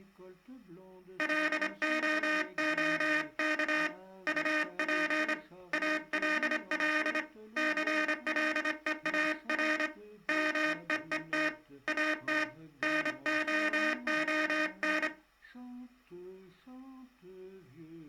Morse code, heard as a buzzer, hand-sent with a straight key, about 25 wpm. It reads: LOOK UP ALL CLEAR MEET AT NOON